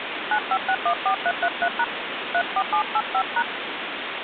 DTMF, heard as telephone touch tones, dialled by hand, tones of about 70 ms, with phone line noise. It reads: 95614333# 34785#